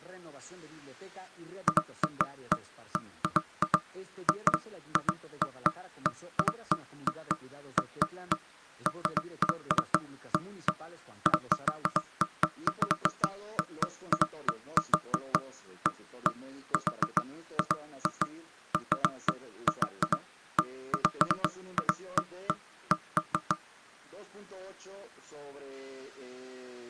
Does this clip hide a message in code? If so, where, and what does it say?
No, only irregular knocks on wood.